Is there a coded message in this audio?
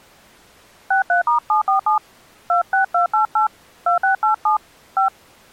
Yes: DTMF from 0.9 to 5.1 s, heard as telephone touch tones, dialled by hand, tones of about 120 ms. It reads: 63*747 26288 2687 5